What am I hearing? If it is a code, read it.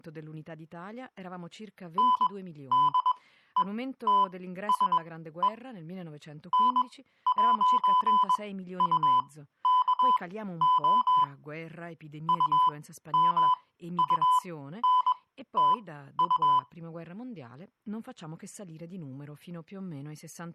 Morse code, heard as electronic beeps, machine-sent, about 21 wpm, spaced as for 13 wpm, 1000 Hz, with speech in Italian. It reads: NDETSE N'UKO UMUNTU